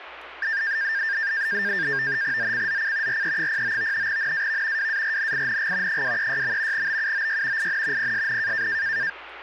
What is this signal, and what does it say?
NAVTEX (SITOR-B), 100 baud, 170 Hz shift, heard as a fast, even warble, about 1700 Hz centre, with radio static and speech in Korean. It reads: ZCZC RE09 NAV WARNING 236. BUOY IN PSN